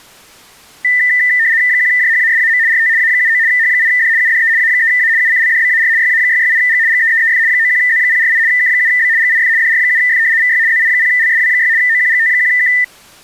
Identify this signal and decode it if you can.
RTTY (75 baud, 170 Hz shift), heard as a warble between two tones, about 1900 Hz centre. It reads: 1JHASAM RT A79 H8D UDE A3A UCLDBAR YA668G GEEEF 91Z048 K7B GIF DR7F VY ZI0LSW6 OQGT1K